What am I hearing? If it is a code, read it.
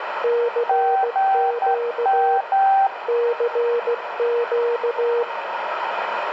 Morse code, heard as two keyed tones, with radio static and room echo. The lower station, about 16 wpm, 470 Hz: CQ CQ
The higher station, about 10 wpm, 780 Hz: GM